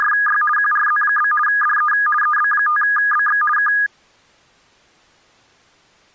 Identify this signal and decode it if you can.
RTTY (50 baud, 450 Hz shift), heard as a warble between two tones, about 1440 Hz centre. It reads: … QRZ? DE EB5BX K